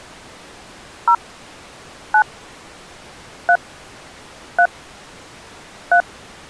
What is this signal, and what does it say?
DTMF, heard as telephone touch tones, dialled by hand, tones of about 80 ms. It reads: 0 9 3 3 3